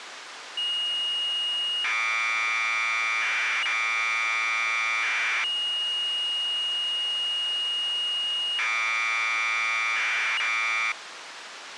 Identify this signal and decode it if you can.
Commodore tape loading (standard loader), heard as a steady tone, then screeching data, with tape hiss.